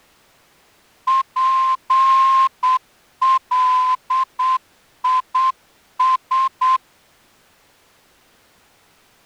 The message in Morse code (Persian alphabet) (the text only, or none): پلیس